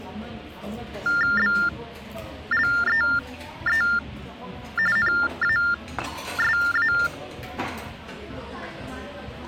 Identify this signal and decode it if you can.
TTY/TDD text telephone tones (45.45 baud Baudot), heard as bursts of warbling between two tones, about 400 Hz shift, 1600 Hz centre, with the noise of a restaurant. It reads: BLEE NASA